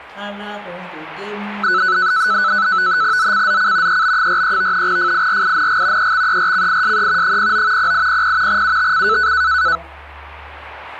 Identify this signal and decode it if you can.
NAVTEX (SITOR-B), 100 baud, 170 Hz shift, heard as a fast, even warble, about 1400 Hz centre. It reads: ZCZC EB43 FIRING EXERCISE 09 0800 UTC